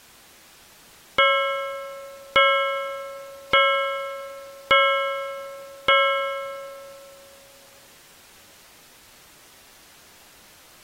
Clock strike, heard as a bell. 5. Five o'clock.